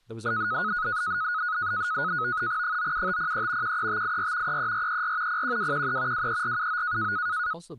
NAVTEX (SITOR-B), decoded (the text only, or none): 97503 13584 33434 01213 23479